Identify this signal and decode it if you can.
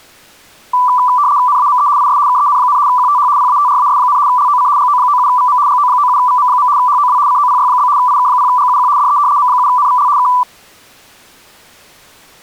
RTTY (75 baud, 170 Hz shift), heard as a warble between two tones, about 1080 Hz centre. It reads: NAME IS KEN, QTH PATRAS, LOC GO97VM GO97VM. HOW COPY? IK0GUQ DE M7NVL K